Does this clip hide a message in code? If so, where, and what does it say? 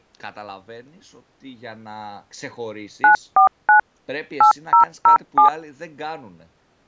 Yes: DTMF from 3.0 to 5.5 s, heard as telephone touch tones, dialled by machine, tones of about 110 ms, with speech in Greek. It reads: 949 8007